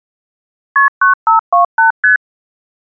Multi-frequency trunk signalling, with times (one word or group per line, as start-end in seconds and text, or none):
0.8-0.9 KP
1.0-1.9 9528
2.0-2.2 ST